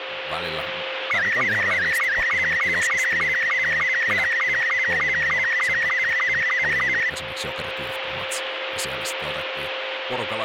SSTV (slow-scan television), Robot 72, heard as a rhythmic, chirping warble, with radio static, a steady whistle near 530 Hz and speech in Finnish.